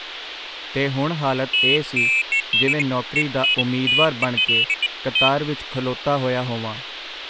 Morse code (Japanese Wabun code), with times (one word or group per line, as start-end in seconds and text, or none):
none